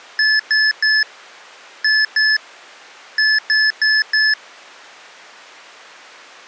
Beep code, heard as beeps from a small speaker, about 1750 Hz. 3-2-4. In Phoenix BIOS tables: keyboard controller failure.